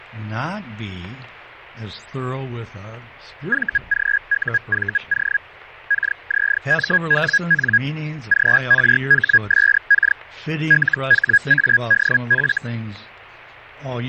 Hellschreiber (Feld-Hell, 122.5 baud), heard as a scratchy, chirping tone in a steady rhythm, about 1650 Hz, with radio static. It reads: VGUVO KZMWN GRHSK LHADF